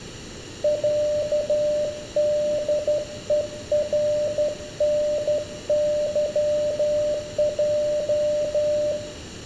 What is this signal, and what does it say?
Morse code (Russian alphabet), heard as a keyed tone, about 12 wpm, 600 Hz, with room echo. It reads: ЯДЕРНЫЙ